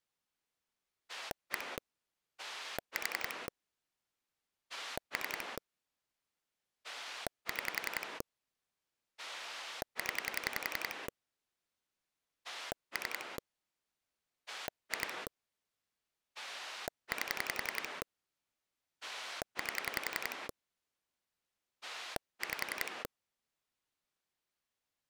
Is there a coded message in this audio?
Yes: pulse dialling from 1.1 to 23.1 s, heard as a rotary dial, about 11 pulses a second. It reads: 1 4 3 6 0 3 2 8 8 5